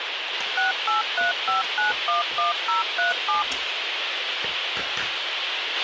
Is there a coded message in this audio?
Yes: DTMF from 0.6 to 3.4 s, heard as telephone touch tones, dialled by machine, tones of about 140 ms, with radio hiss, a squelch burst at the end and kitchen noise. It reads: 6835911037